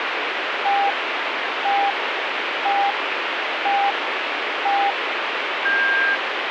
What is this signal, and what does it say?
Radio time signal (five pips and a higher one, as on Chinese radio), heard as pips, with radio static.